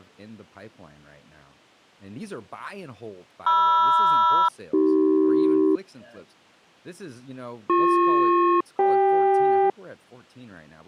Aircraft SELCAL, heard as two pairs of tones, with speech in English. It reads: MR-AC BP-CK